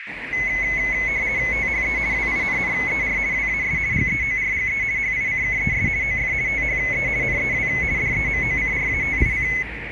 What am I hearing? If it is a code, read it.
RTTY (50 baud, 170 Hz shift), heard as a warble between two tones, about 2100 Hz centre, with radio static, a narrow filter and street noise. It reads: THE WINNER WAS GEORGE HICKES OF THE NEW DEMOCRATIC